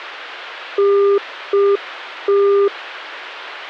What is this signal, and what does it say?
Telephone call progress tone (UK plan), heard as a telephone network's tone, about 400 Hz. Congestion tone.